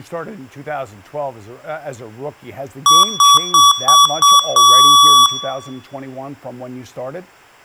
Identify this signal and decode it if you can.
Beep code, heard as beeps from a small speaker, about 1140 Hz, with room echo and speech in English. 5 short, 1 long.